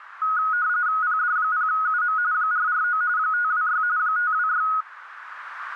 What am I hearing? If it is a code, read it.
RTTY (45.45 baud, 170 Hz shift), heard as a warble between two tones, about 1360 Hz centre, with radio static. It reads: PD0UM 449 526 526